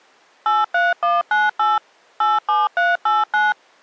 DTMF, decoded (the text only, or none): 83198 87389